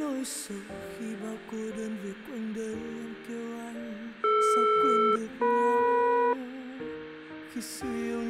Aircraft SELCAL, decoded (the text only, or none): DR-EM